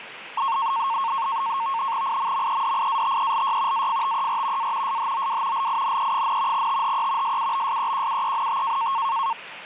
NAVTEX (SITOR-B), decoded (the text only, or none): IMMEDIATELY AFTER A SHOW LINE, THE SUBSEQUENT